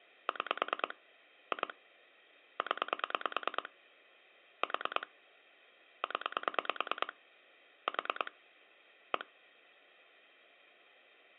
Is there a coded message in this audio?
Yes: pulse dialling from 0.3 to 9.2 s, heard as clicks on a phone line, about 9 pulses a second. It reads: 6 2 0 4 0 4 1